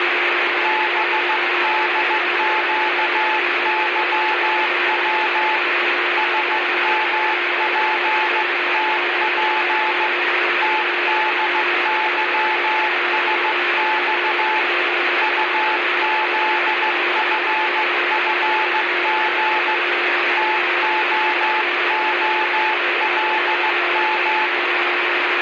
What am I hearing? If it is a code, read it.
Morse code, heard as a keyed tone, hand-sent with a straight key, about 15 wpm, 870 Hz, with radio static and a steady whistle near 350 Hz. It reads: BDQYW SMPTP TDYSX UZFFG TOOLM